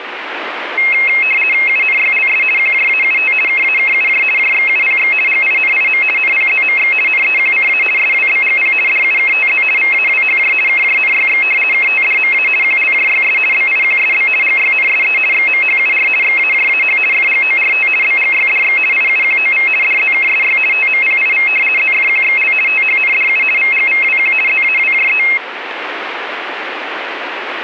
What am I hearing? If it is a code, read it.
RTTY (50 baud, 450 Hz shift), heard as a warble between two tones, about 2350 Hz centre, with radio static. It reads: UNYLS QJAUT KAKUJ JXUPX GINIM NPZMX NEQCA SWBGP DUKTZ VAWHJ KJNYX KTDMA QLJYS BIQSB GYNSE XMHUR XAJAH FGORT BGYDX IUQOV DZKSY TMPIV ZFQXL THNDU VGVWQ ZAWJE